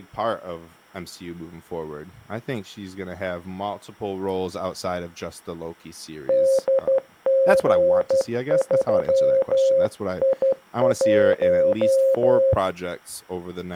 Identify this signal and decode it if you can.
Morse code, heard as a keyed tone, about 12 wpm, 540 Hz, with speech in English. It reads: DG3I1